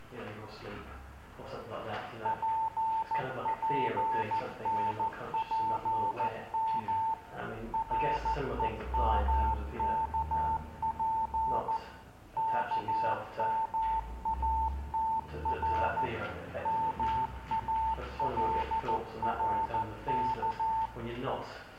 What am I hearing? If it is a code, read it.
Morse code, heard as a keyed tone, machine-sent, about 14 wpm, 890 Hz, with room echo. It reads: PPNPM REMKP KMATR MALRK